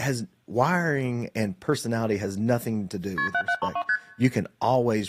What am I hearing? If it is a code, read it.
Multi-frequency trunk signalling (R1, as on North American trunks), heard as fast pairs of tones, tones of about 70 ms, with speech in English. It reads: KP 7732 ST